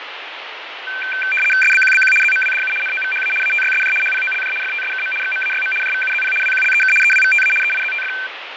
RTTY (75 baud, 850 Hz shift), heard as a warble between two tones, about 1950 Hz centre, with radio static and fading. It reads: SBQBQ ZMWDU NOVHA ATYSJ HPOLJ FTSKM XMAYM JVUZP WQLEK EWVTA EIZTF